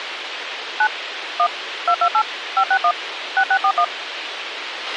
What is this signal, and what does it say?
DTMF, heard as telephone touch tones, dialled by machine, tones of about 70 ms, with radio hiss and a squelch burst at the end. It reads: 9 1 228 561 6641